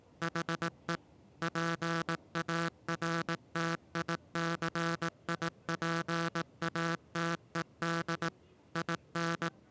Morse code, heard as a buzzer, machine-sent, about 18 wpm, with the noise inside a subway train. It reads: HE PARTICIPATED IN